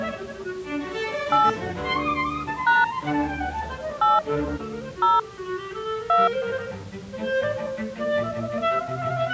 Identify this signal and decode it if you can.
DTMF, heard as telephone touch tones, dialled by hand, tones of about 180 ms. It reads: 8 # 8 0 2